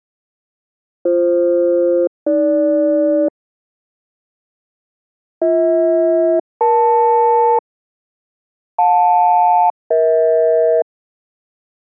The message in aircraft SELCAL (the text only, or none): BF-AG BH-EL JL-EH